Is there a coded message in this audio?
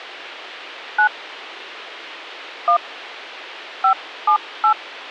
Yes: DTMF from 1.0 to 4.7 s, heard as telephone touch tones, dialled by hand, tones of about 90 ms, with a squelch burst at the end. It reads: 9 1 578